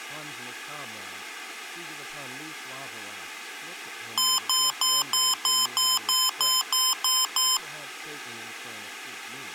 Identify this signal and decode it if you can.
Beep code, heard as beeps from a small speaker, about 1030 Hz, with room echo and speech in English. 11 short. In AMI BIOS tables: cache memory error.